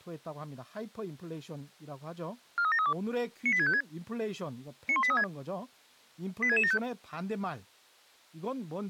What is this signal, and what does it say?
Five-tone selective call (ZVEI), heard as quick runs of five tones, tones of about 70 ms, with speech in Korean. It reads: 43732 98656 91836 86675